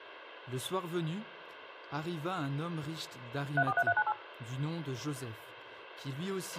DTMF, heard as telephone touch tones, dialled by machine, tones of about 60 ms, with a squelch burst at the end and speech in French. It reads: 343398